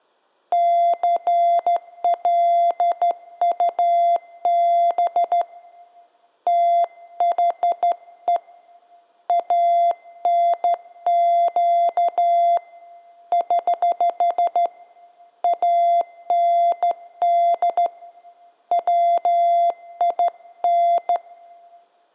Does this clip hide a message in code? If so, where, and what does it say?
Yes: Morse code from 0.5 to 21.2 s, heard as a keyed tone, hand-sent with a straight key, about 13 wpm, 690 Hz. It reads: CLUB THE ANQ <HH> AND WIN